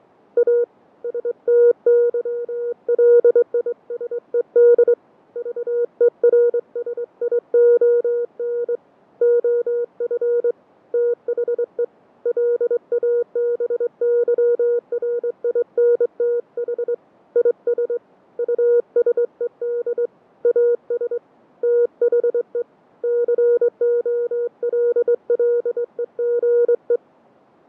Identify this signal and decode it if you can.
Morse code, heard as a keyed tone, hand-sent with a straight key, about 23 wpm, 480 Hz, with fading. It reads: A STYLISED VERSION OF THE LABYRINTH IS USED AS THE COLLEGE